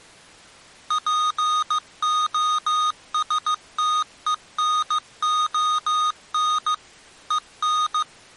Morse code, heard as electronic beeps, machine-sent, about 15 wpm, 1240 Hz. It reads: POSTENON EN